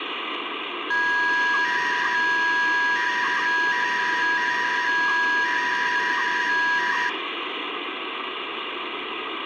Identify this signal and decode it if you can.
300-baud modem data (V.21 tones), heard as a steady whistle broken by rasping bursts, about 300 baud, 200 Hz shift, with phone line noise.